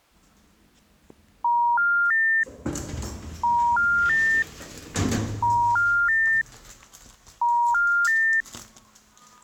Telephone call progress tone (ITU plan), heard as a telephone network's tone, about 950, 1400, 1800 Hz, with the noise inside a lift. Special information tone.